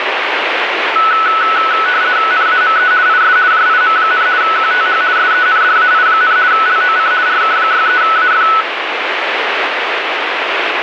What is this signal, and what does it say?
RTTY (50 baud, 170 Hz shift), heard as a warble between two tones, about 1390 Hz centre, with radio static. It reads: NAME IS JIM, QTH SENDAI, LOC RK63AF